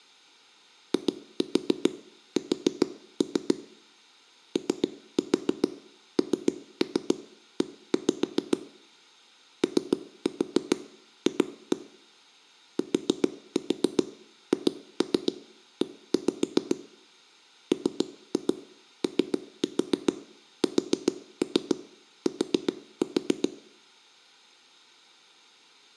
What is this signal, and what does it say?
Tap code, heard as knocks on a wall, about 7 knocks a second, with room echo. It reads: IS ONE OF THE MOST